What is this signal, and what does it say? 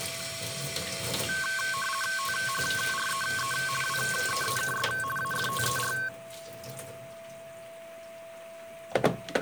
RTTY (50 baud, 450 Hz shift), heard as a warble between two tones, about 1320 Hz centre, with a steady whistle near 660 Hz and kitchen noise. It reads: THREE WEEKS AFTER